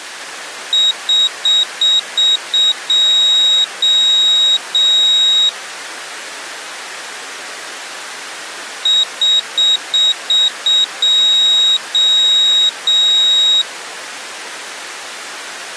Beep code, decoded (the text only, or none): 6 short, 3 long